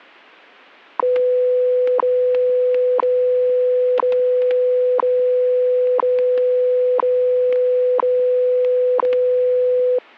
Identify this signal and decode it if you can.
Radio time signal (WWV, Colorado), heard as ticks, one a second, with static crashes.